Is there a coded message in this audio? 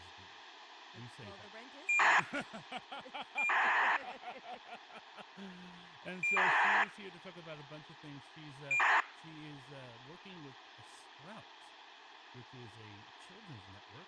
Yes: ACARS aircraft data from 1.9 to 9.0 s, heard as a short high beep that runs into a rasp, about 2400 baud, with speech in English.